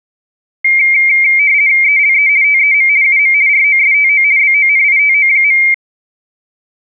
RTTY (50 baud, 170 Hz shift), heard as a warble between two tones, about 2200 Hz centre. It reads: ELE TEM UM ROSTO BONITO.